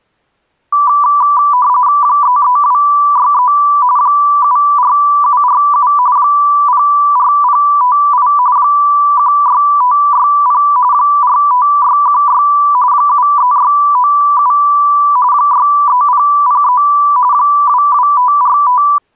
RTTY (45.45 baud, 170 Hz shift), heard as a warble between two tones, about 1080 Hz centre. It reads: 33263 74747 04058 16560 45616 73697 63003 22545